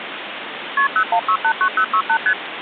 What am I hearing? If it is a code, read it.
Multi-frequency trunk signalling (R1, as on North American trunks), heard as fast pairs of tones, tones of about 80 ms, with phone line noise. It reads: KP 01689068 ST